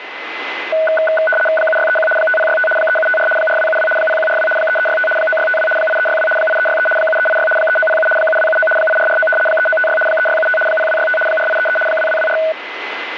RTTY (75 baud, 850 Hz shift), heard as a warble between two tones, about 1060 Hz centre, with radio static and a steady whistle near 2030 Hz. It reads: 7631 5065 3754 4272 0142 3365 9652 8362 8363 7386 3907 7279 8449 3956 3675 0265 4833 2224